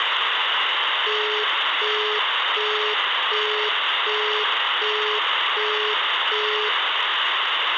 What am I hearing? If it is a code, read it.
Telephone call progress tone (as in the UK, Australia and similar networks), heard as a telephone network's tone, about 420 Hz, 0.375 s on and 0.375 s off, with phone line noise and room echo. Busy tone.